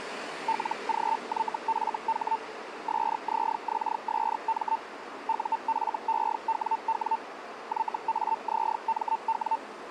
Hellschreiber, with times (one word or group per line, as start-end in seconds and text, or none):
0.5-2.4 LGYFH
2.9-4.8 SZXSM
5.3-7.2 UFEWW
7.7-9.6 YAZMW